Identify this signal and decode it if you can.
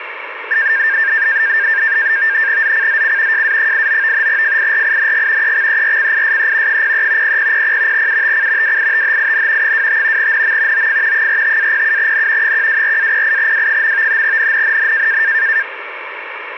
NAVTEX (SITOR-B), 100 baud, 170 Hz shift, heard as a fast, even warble, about 1700 Hz centre, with radio static. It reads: ZCZC JA89 FIRING EXERCISE 03 0000 UTC WITHIN 25 NM OF 45-07N 124-08W. NNNN